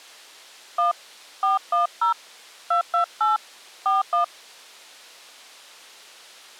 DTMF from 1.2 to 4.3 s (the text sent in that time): 410 228 41